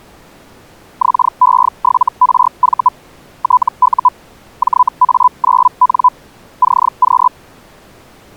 Hellschreiber (Feld-Hell, 122.5 baud), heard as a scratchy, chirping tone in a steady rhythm, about 1000 Hz. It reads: XE7RV TU JA9N CQ